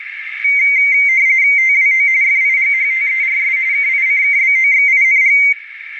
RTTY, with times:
1.6-2.1 TWO
2.2-3.6 FIGHTERS
3.7-5.4 KICKBOXING

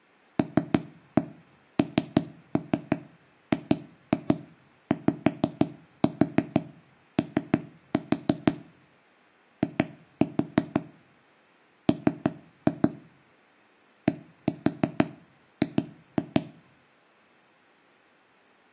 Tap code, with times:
0.4-8.5 LNGYO
9.6-10.8 I
11.9-12.9 M
14.1-16.4 DG

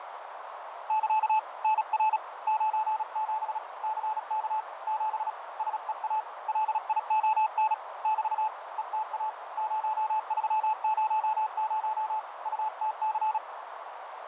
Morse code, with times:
0.9-1.4 <KA>
1.6-2.2 NR
2.5-3.6 97
3.8-4.6 CK
4.9-5.3 7
5.6-6.2 SEA
6.5-7.7 LION
8.0-8.5 <BT>
8.8-9.3 ETA
9.6-12.2 0300
12.5-13.4 UTC

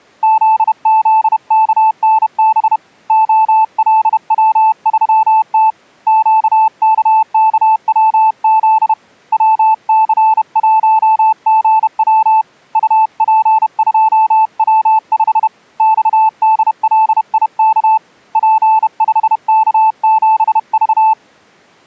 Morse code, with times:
0.2-2.8 ZZKNB
3.1-5.7 OLW3T
6.1-8.9 QKKWZ
9.3-12.4 WC1GW
12.8-15.5 UP2W5
15.8-18.0 XDLIK
18.4-21.1 P5K7V

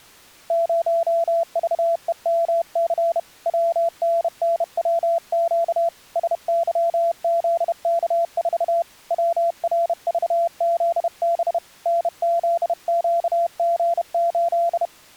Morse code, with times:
0.5-3.2 0VEMC
3.5-5.9 WNNWQ
6.2-8.8 SYZK4
9.1-11.6 WRVZB
11.9-14.9 NZQG8

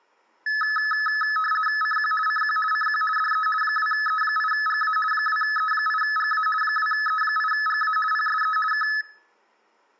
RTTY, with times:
1.8-2.1 CQ
2.3-2.6 CQ
2.7-3.0 CQ
3.2-3.5 DE
3.6-5.0 2E8GA
5.1-6.5 2E8GA
6.6-8.0 2E8GA
8.1-8.6 PSE
8.7-8.9 K

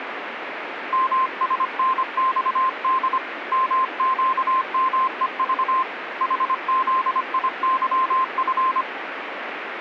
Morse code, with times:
0.9-3.2 MSNXD
3.5-5.8 MQMEV
6.2-8.8 HZIYF

